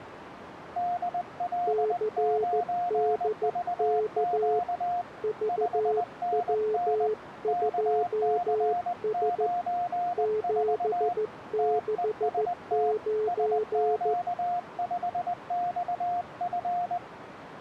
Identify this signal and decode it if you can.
Morse code, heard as two keyed tones, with radio static. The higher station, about 20 wpm, 710 Hz: DL9VQ 5NN KC94 TEST SQ5XF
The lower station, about 14 wpm, 430 Hz: CDK VW2S 769